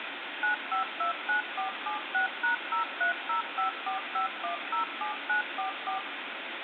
DTMF, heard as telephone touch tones, dialled by machine, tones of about 120 ms, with phone line noise and room echo. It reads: 9529476#030545107944